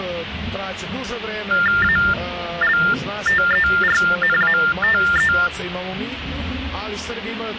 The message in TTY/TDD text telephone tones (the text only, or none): ALTERNATE